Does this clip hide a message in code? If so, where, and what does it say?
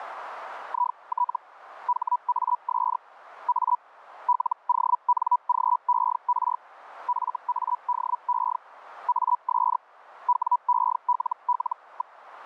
Yes: Hellschreiber (Feld-Hell, 122.5 baud) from 0.7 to 12.2 s, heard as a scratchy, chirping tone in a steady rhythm, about 980 Hz. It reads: IT HAS A LONGER FADE AS WELL.